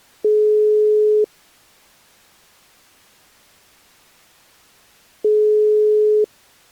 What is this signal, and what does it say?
Telephone call progress tone (single-tone plan, as in most of Europe), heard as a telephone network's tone, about 420 Hz, 1 s on and 4 s off. Ringback tone.